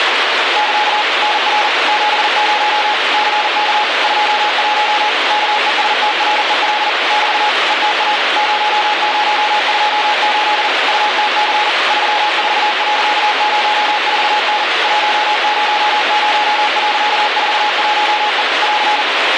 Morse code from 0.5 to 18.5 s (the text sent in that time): <KA> NR 70 CK 21 KESTREL <BT> ETA 0028 UTC 34.04N 100.41E